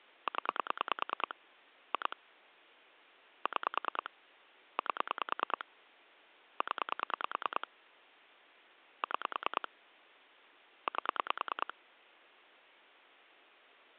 Pulse dialling, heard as clicks on a phone line, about 9 pulses a second. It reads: 0 2 6 8 0 6 8